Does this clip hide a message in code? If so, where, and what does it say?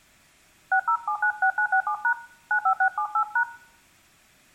Yes: DTMF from 0.7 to 3.4 s, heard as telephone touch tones, dialled by hand, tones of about 80 ms, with room echo. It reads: 60796967# 95678#